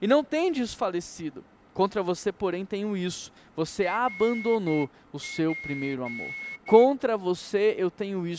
Morse code (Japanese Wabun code), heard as a whistle, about 9 wpm, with speech in Portuguese. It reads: ナツ